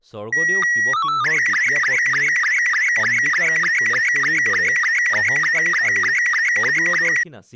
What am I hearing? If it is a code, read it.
SSTV (slow-scan television), Robot 72, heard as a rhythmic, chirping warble, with speech in Assamese.